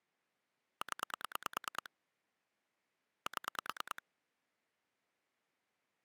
Pulse dialling, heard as clicks on a phone line, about 9 pulses a second. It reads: 0 7